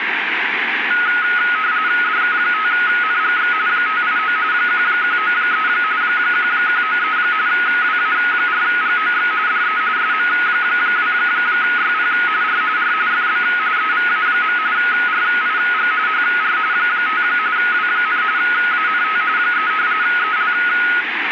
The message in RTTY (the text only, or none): DK5NGX 589 1193 1193 WA4GOX DE SM2YP R R FB EVA. RIG HR 5 W, ANT 3 EL